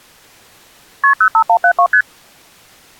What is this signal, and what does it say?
Multi-frequency trunk signalling (R1, as on North American trunks), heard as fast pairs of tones, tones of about 80 ms. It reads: KP 05172 ST